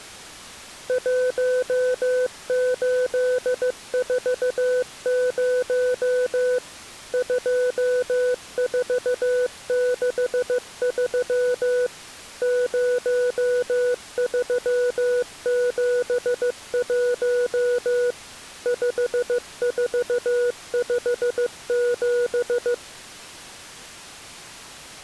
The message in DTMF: none

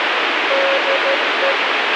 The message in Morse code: DE

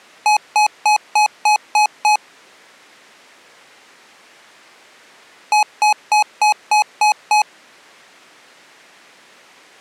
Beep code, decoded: 7 short

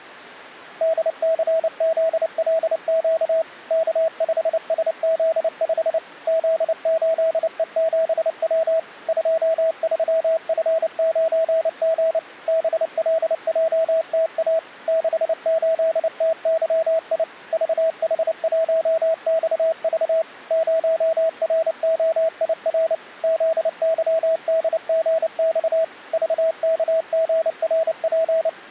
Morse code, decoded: DCZLQ K5SZ5 Z8E7W 23F9G BLJTA 68TYI VH1XV 0ROIR ZYDGX VKGRP

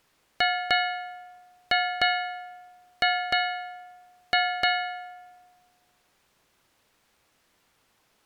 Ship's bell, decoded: 8

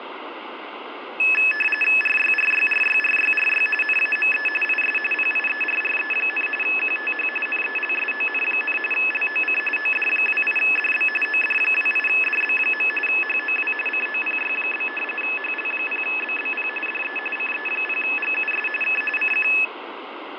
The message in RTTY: RYRYRYRYRY NAME IS PIERRE, QTH NELSON, LOC OD28DB OD28DB. HOW COPY? HL0BBP DE CE0GUS K CQ

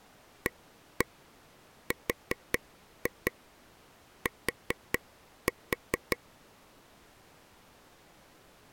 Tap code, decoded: ART

